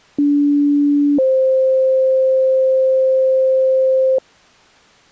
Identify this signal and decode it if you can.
Two-tone page, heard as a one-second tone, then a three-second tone, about 290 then 520 Hz.